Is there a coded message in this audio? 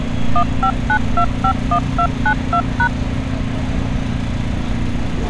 Yes: DTMF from 0.4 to 2.9 s, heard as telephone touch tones, dialled by machine, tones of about 80 ms, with street noise. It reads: 159251292#